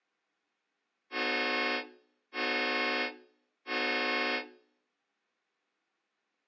Train horn signal, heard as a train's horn, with room echo. 3 short. On North American railways: when stopped, the train will back up.